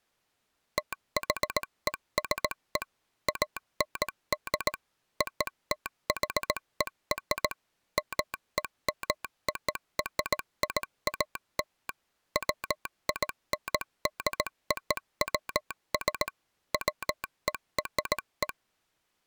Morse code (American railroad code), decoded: THESE AND OTHER MEMORIAL WINDOWS WERE

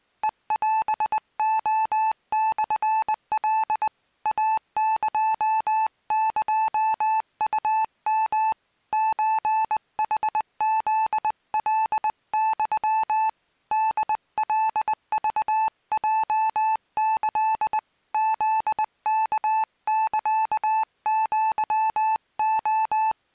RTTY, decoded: none

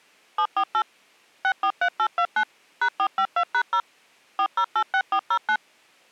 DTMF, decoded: 748 643829 #452#0 4086409

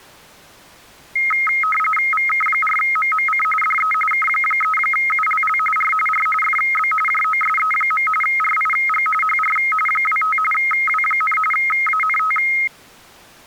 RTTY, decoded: VK4MMC DE K3ULL R R FB JOSE. RIG HR 25 W, ANT

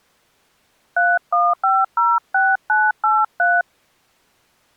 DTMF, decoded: 31506983

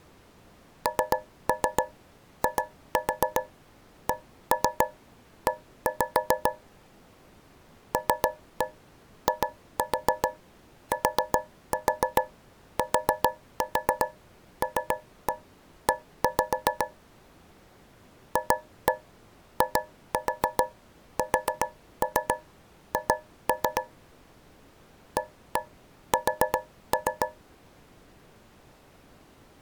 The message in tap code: NICE LITTLE FISH AS

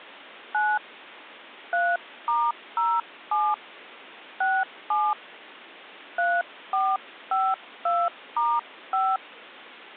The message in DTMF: 9 3*07 67 3452*5

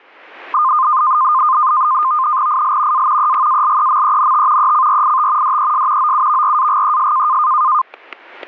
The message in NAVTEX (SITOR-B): IL A EGALEMENT ECRIT DES OUVRAGES

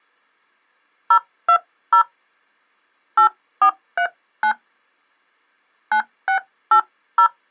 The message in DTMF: 020 8439 9680

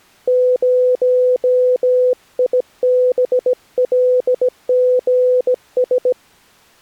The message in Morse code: 0IBLGS

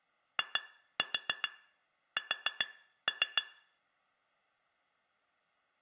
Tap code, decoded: IS

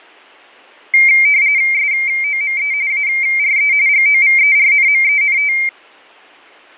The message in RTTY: SOME ARE GOVERNMENT

